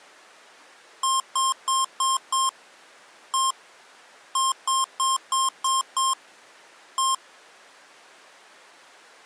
Beep code, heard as beeps from a small speaker, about 1060 Hz. 5-1-6-1.